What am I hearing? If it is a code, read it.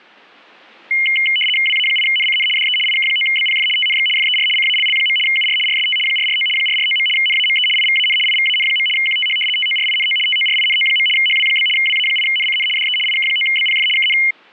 RTTY (75 baud, 850 Hz shift), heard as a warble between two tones, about 2550 Hz centre. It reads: WA8NCN DE IK9BPF TNX FER CALL. UR RST 449 449. NAME IVAN IVAN. QTH TORINO TORINO. HW? WA8NCN DE IK9BPF KN